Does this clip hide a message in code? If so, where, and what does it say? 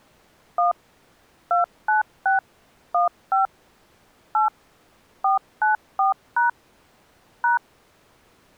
Yes: DTMF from 0.6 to 7.6 s, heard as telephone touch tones, dialled by machine, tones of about 130 ms. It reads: 1 296 15 8 494# #